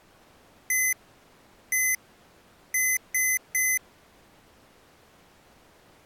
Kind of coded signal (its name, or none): beep code